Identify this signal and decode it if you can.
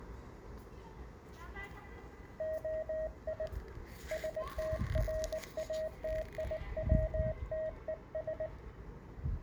Morse code (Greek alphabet), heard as a keyed tone, hand-sent with a paddle, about 19 wpm, 630 Hz, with the noise of a residential street. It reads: ΟΙ ΣΤΡΑΤΙΩΤΕΣ